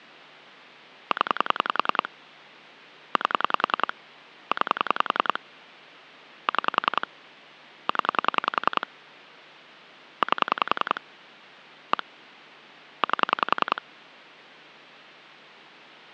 Pulse dialling, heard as clicks on a phone line, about 10 pulses a second. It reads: 0 8 9 6 0 8 1 8